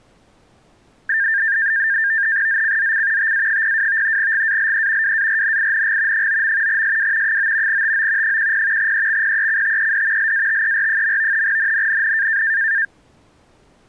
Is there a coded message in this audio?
Yes: NAVTEX (SITOR-B), 100 baud, 170 Hz shift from 1.1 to 12.9 s, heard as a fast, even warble, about 1700 Hz centre. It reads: ZCZC TA02 GALE WARNING 9. SW 9 TO 10 EXPECTED LATER. NNNN